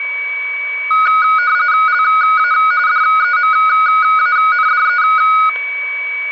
RTTY (45.45 baud, 170 Hz shift), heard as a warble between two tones, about 1360 Hz centre, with static crashes and a steady whistle near 2270 Hz. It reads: LA DEMANDE